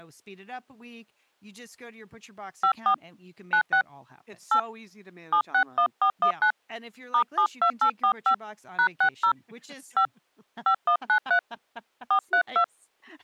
DTMF, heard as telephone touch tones, dialled by hand, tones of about 80 ms, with speech in English. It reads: 54 96 8 761419 *72845 #60 5 5193 432